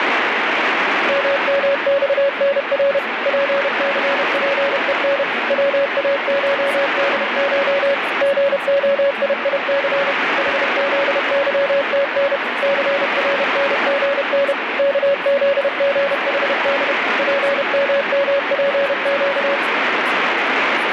Morse code (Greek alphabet), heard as a keyed tone, machine-sent, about 31 wpm, 560 Hz, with heavy radio static. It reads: ΜΜΞΝΡ ΠΘΠΕΝ ΩΑΧΔΧ ΓΟΙΙΘ ΗΖΥΤΝ ΘΡΝΓΝ ΚΖΓΗΔ ΠΜΜΠΨ